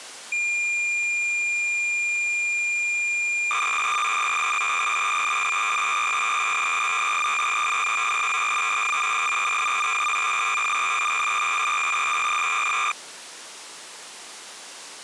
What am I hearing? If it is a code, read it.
Cassette data (Kansas City type), 300 baud, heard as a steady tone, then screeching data.